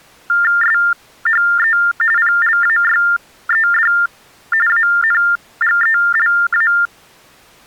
TTY/TDD text telephone tones (45.45 baud Baudot), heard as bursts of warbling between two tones, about 400 Hz shift, 1600 Hz centre. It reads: SHE PLAYED ANGELA